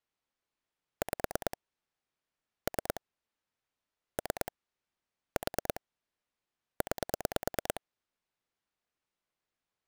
Pulse dialling, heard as clicks on a phone line, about 9 pulses a second. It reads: 5 3 3 4 9